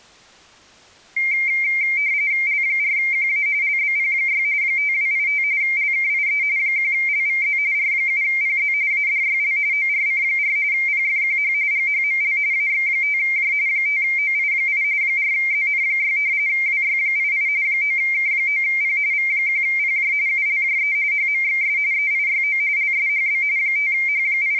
RTTY (45.45 baud, 170 Hz shift), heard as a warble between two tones, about 2200 Hz centre. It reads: L4QA LBP6 5285 LKIE 1LVZ R7PZ ADYL ORC4 PFQH GHML AX5J 5OI8 4ZN6 WY88 9K9P V1PJ ULJE HMXS EIYO LSHB …